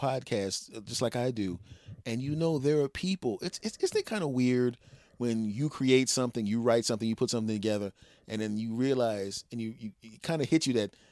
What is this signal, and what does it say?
Speech in English. There is no code.